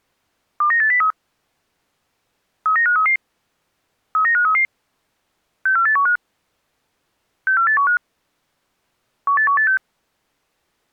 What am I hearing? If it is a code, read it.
Five-tone selective call (CCIR), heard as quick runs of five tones, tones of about 100 ms. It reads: 29803 39533 39533 64815 64815 18186